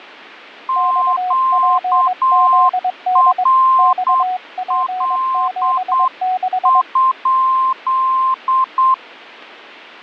Morse code, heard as two keyed tones. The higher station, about 8 wpm, 1050 Hz: QRL?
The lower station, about 22 wpm, 740 Hz: XPZD XP76